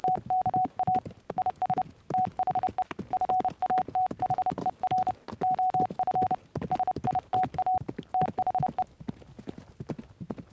Morse code, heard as a keyed tone, hand-sent with a paddle, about 30 wpm, 740 Hz. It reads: … IS THE FATHER OF SITA THE